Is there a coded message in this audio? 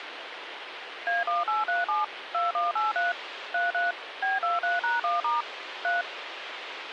Yes: DTMF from 1.1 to 6.0 s, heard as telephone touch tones, dialled by machine, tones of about 160 ms, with radio hiss and a squelch burst at the end. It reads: A1837 2183 33 B23#1* 3